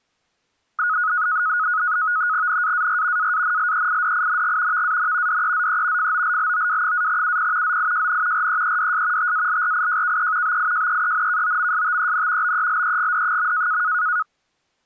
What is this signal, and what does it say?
NAVTEX (SITOR-B), 100 baud, 170 Hz shift, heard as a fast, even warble, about 1360 Hz centre. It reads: NAAR AANLEIDING VAN DEZE FOLLOW-UP ZIJN REEDS TALRIJKE BIJEENKOMSTEN BELEGD.